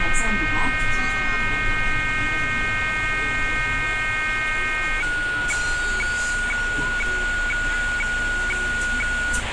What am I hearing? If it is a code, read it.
Weather fax (radiofax), 120 lines a minute, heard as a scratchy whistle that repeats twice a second, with radio static and the noise inside a bus.